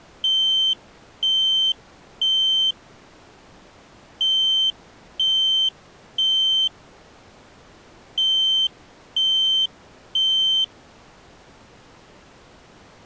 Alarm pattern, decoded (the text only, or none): temporal three